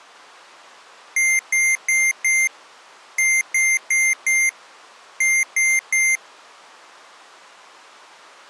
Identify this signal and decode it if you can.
Beep code, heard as beeps from a small speaker, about 2100 Hz. 4-4-3. In Phoenix BIOS tables: maths coprocessor failure.